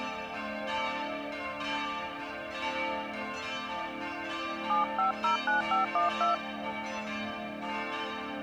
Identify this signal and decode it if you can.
DTMF, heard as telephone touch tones, dialled by hand, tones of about 130 ms. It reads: 7509512